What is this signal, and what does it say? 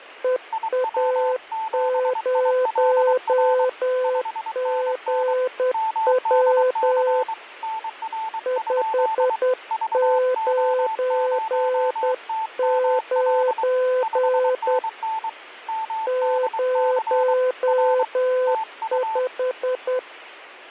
Morse code, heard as two keyed tones. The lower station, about 10 wpm, 510 Hz: EA0GW 599 05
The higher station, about 23 wpm, 880 Hz: IW7ILR 5NN MDC NR? VO0TML 5NN MDC R TU